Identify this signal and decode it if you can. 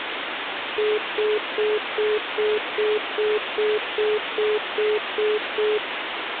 Telephone call progress tone (single-tone plan, as in most of Europe), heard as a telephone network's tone, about 420 Hz, 0.2 s on and 0.2 s off, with phone line noise. Congestion tone.